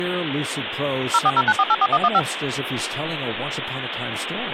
DTMF, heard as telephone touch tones, dialled by machine, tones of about 50 ms, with phone line noise and speech in English. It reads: 0409484115